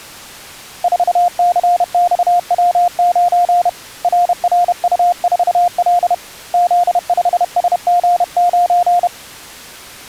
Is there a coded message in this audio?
Yes: Morse code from 0.8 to 9.1 s, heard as a keyed tone, hand-sent with a paddle, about 31 wpm, 710 Hz. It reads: 4CXW9 RRU4L Z5SG9